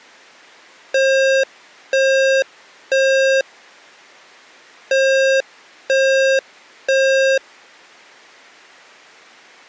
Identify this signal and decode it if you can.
Alarm pattern, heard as an alarm's beeps, played twice, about 540 Hz. Temporal three. Smoke or fire, evacuate.